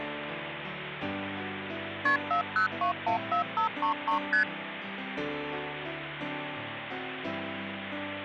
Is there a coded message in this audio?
Yes: multi-frequency trunk signalling (R1, as on North American trunks) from 2.1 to 4.4 s, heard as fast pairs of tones, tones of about 110 ms, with phone line noise. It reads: KP 40214533 ST